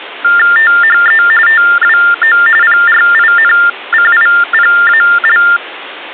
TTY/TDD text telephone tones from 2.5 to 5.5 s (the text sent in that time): PRINCIPAL